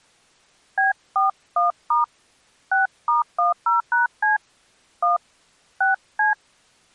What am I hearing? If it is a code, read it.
DTMF, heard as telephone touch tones, dialled by hand, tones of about 140 ms. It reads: B41* 6*10#C 1 6C